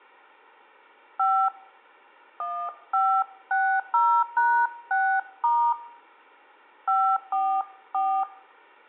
DTMF, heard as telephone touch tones, dialled by hand, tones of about 290 ms. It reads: 5 1560#6* 544